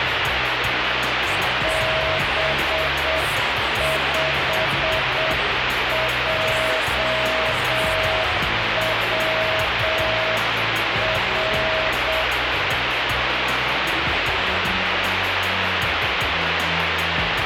Morse code, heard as a keyed tone, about 7 wpm, 640 Hz, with heavy radio static. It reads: B5JWR